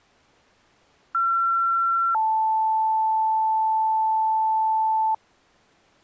Two-tone page, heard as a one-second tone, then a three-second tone, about 1360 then 880 Hz.